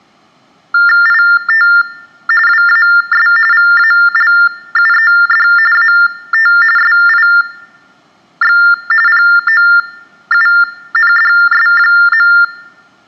TTY/TDD text telephone tones (45.45 baud Baudot), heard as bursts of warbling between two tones, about 400 Hz shift, 1600 Hz centre. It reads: IT WAS VALUED AT SIX POUNDS.